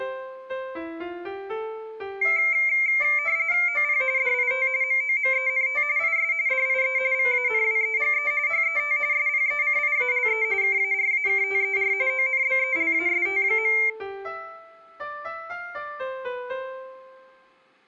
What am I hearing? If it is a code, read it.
RTTY (45.45 baud, 170 Hz shift), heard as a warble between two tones, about 2200 Hz centre. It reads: OP DIT MOMENT IS DIE VANWEGE HET SPECIALE KARAKTER ONBELAST.